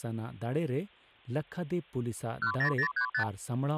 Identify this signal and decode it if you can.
Multi-frequency trunk signalling (R2, with the far end's replies), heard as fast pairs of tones, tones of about 90 ms, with speech in Santali. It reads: 10035